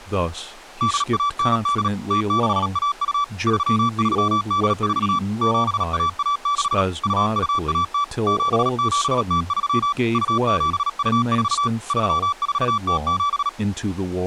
Morse code (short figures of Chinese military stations), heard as a keyed tone, machine-sent, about 37 wpm, 1160 Hz, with speech in English. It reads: 8198 0612 3384 7116 2210 7703 2724 3407